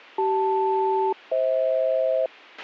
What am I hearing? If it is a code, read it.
Aircraft SELCAL, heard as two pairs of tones, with a squelch burst at the end. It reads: CL-FH